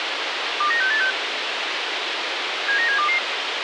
Five-tone selective call (CCIR), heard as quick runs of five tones, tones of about 100 ms, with radio hiss and a squelch burst at the end. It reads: 29686 79722